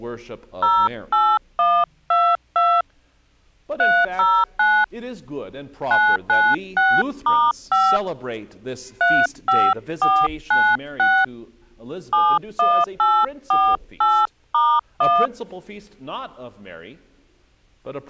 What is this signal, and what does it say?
DTMF, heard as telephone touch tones, dialled by hand, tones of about 250 ms. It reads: 08122 309 996*5 35496 71848*1